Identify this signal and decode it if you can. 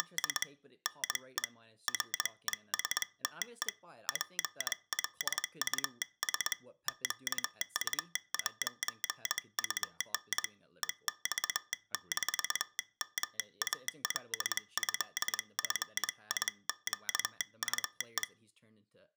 Morse code (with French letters), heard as a telegraph sounder, hand-sent with a straight key, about 21 wpm, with speech in English. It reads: … NE RESTE PLUS QU'UN EX-MALÉFIQUE